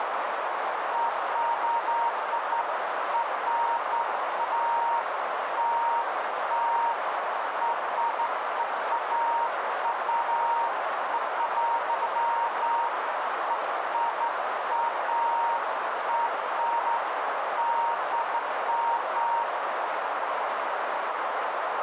Beeps of irregular length, with heavy radio static and a narrow filter. There is no code.